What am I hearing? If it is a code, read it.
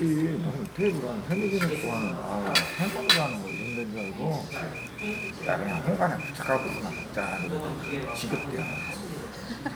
Morse code (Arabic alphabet), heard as a whistle, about 10 wpm, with the noise of a crowd indoors. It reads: ءمزهعض